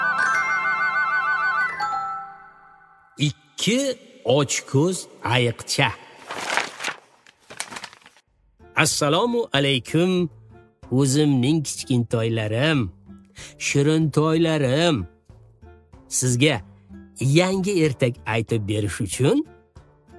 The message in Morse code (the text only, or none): none